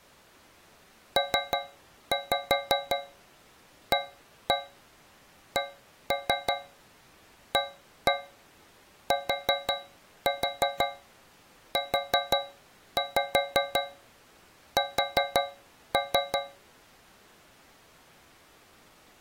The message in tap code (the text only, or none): PACATUS